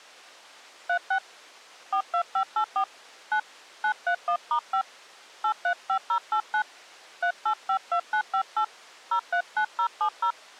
DTMF, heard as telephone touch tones, dialled by hand, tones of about 80 ms. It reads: 36 42584 9 931*5 835089 3852958 039070